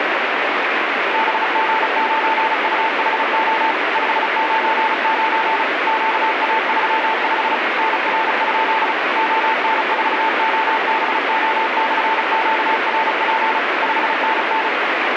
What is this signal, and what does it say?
Morse code, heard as a keyed tone, machine-sent, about 35 wpm, 890 Hz, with heavy radio static. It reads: BG9UHO 599 QA35 NR? ON4OBO/QRP 5NN